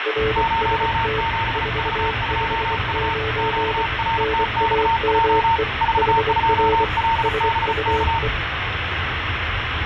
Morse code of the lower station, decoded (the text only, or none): RST 459 NAME HR SUE